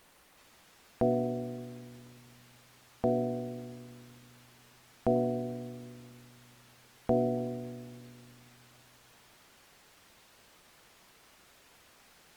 Clock strike, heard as a bell. 4. Four o'clock.